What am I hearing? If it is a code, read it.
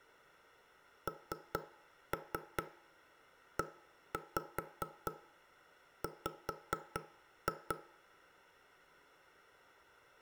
Tap code, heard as knocks on wood, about 4 knocks a second, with room echo. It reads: NEW